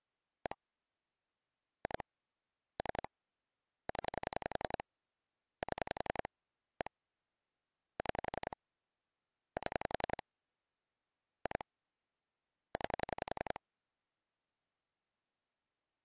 Pulse dialling, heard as clicks on a phone line, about 11 pulses a second. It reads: 1 2 3 0 7 1 6 7 2 9